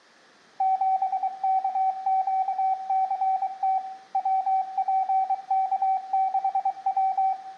Morse code, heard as a keyed tone, machine-sent, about 23 wpm, 760 Hz, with room echo. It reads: 7KQCT WPK6W